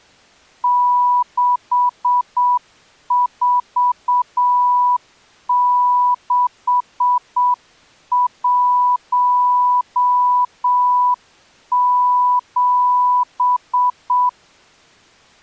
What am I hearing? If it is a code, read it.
Morse code, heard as a keyed tone, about 7 wpm, 990 Hz. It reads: 64617